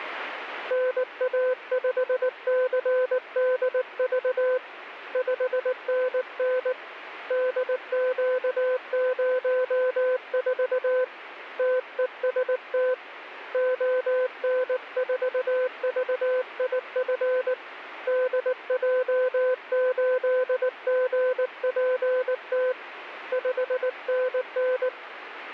Morse code, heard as a keyed tone, hand-sent with a paddle, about 19 wpm, 510 Hz, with radio static. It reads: NA5CDV 5NN DQ04 TEST ON4VIF DJ8GPT 5NN